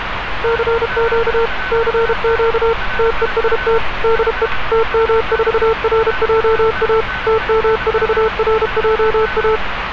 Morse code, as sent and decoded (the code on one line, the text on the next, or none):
-.-. --.- / -.-. --.- / - . ... - / -.. . / - -- ....- .-. .--- .- / - -- ....- .-. .--- .-
CQ CQ TEST DE TM4RJA TM4RJA